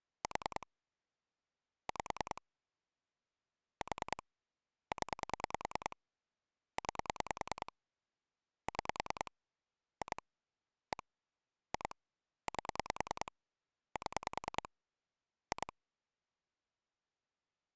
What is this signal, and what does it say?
Pulse dialling, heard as clicks on a phone line, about 10 pulses a second. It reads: 4 5 4 0 9 6 2 1 2 8 7 2